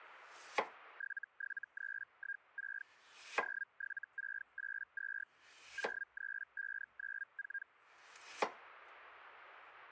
Hellschreiber (Feld-Hell, 122.5 baud), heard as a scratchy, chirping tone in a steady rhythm, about 1600 Hz, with kitchen noise. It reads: 77316 07682 03594